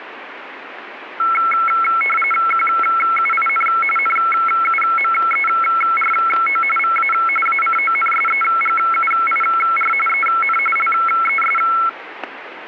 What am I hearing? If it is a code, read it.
RTTY (45.45 baud, 850 Hz shift), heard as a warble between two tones, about 1750 Hz centre, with radio static and static crashes. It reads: QUIN NUMERO VA ACONSEGUIR EN LES